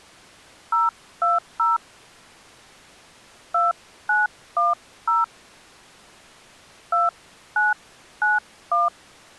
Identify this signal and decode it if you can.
DTMF, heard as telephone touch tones, dialled by hand, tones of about 170 ms. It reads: 020 2910 2991